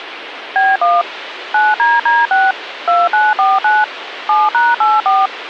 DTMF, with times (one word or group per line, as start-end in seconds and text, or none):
0.6-1.0 B1
1.5-2.5 9DD6
2.9-3.8 2949
4.3-5.3 7#84